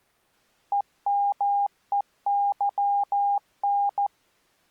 Morse code, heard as a keyed tone, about 14 wpm, 810 Hz. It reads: EMEYN